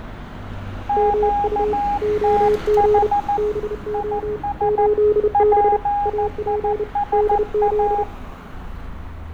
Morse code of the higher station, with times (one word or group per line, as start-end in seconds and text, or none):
0.9-3.4 QTH
3.9-4.9 IS
5.3-8.0 PISA